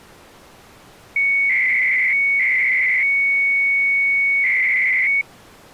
300-baud modem data (Bell 103 tones), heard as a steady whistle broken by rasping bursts, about 300 baud, 200 Hz shift.